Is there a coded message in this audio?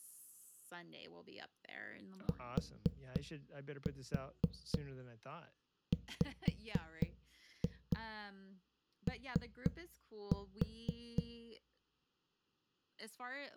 Yes: tap code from 2.3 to 11.2 s, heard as knocks on a wall, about 4 knocks a second, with speech in English. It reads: TWO